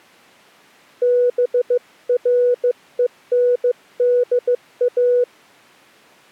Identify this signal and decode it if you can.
Morse code, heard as a keyed tone, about 15 wpm, 490 Hz. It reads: BRENDA